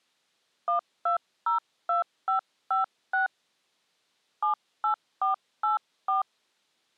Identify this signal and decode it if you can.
DTMF, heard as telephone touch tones, dialled by hand, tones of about 120 ms. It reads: 1202556 78484